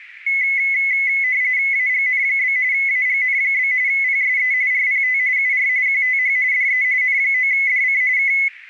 RTTY (45.45 baud, 170 Hz shift), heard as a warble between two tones, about 2100 Hz centre, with radio static. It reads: AGN? AGN? PSE RPT UR QTH DE N9DC K